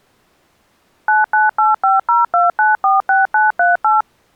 DTMF, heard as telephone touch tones, dialled by machine, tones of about 160 ms. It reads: 998502946938